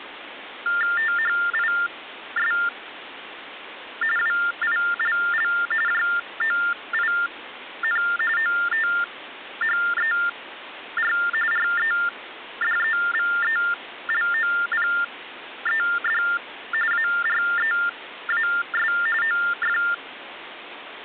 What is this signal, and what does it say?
TTY/TDD text telephone tones (45.45 baud Baudot), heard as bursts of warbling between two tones, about 400 Hz shift, 1600 Hz centre, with phone line noise. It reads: THIS WILL JOIN OTHER REDEVELOPED AREAS OF